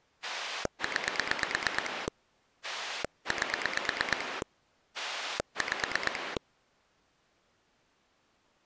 Pulse dialling, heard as a rotary dial, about 8 pulses a second. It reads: 9 8 5